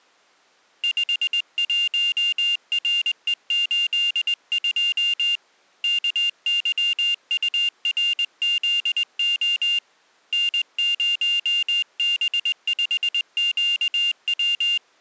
Morse code, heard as a high beeper, hand-sent with a straight key, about 20 wpm, 2800 Hz. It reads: 51RE82 KYURZO N0B5QW